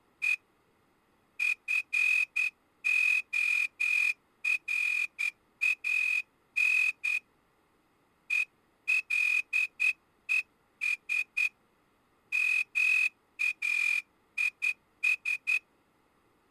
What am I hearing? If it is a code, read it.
Morse code, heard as a whistle, hand-sent with a straight key, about 10 wpm. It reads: E FORAN ELES MAIS